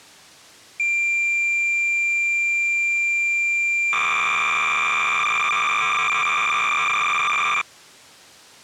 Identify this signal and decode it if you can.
Cassette data (Kansas City type), 300 baud, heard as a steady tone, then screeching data.